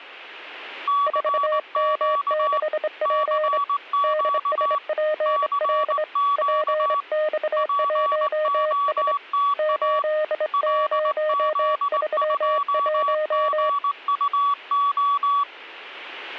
Morse code, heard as two keyed tones. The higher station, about 19 wpm, 1140 Hz: CQ CQ CQ POTA LZ2GUO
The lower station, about 25 wpm, 620 Hz: 4M6P DSPL PX1S 8031